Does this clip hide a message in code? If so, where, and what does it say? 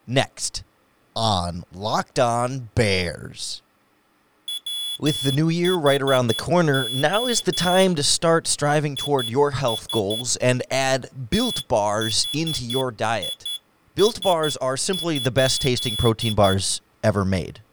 Yes: Morse code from 4.4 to 16.6 s, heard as a high beeper, hand-sent with a straight key, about 11 wpm, 3400 Hz, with speech in English. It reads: WHO IS THIS?